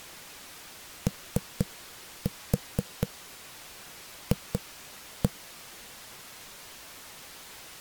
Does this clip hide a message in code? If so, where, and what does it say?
Yes: tap code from 1.1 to 5.3 s, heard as knocks on a wall, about 4 knocks a second. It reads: OF